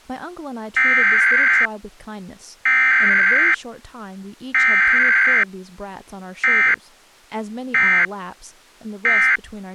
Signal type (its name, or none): Emergency Alert System (SAME) tones